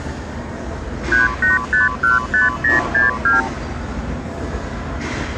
Multi-frequency trunk signalling (R2, with the far end's replies), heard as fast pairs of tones, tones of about 150 ms, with the noise inside a lift. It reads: 38515062